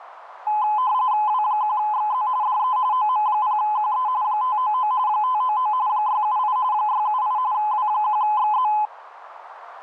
RTTY (45.45 baud, 170 Hz shift), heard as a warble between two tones, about 930 Hz centre, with radio static. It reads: W1XZ DE OM0QE 599 599 678 678 W1XZ